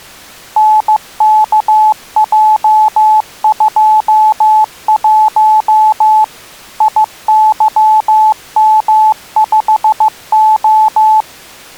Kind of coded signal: Morse code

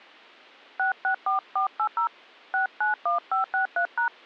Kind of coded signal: DTMF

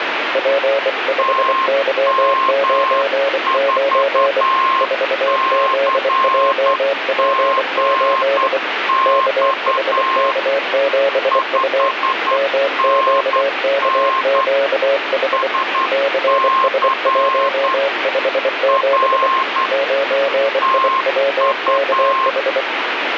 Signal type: Morse code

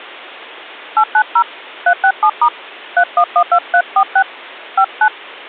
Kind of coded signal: DTMF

